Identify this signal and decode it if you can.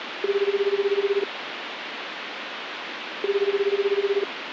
Telephone call progress tone (Japanese plan), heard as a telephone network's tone, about 380, 400, 420 Hz, 1 s on and 2 s off, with phone line noise. Ringback tone.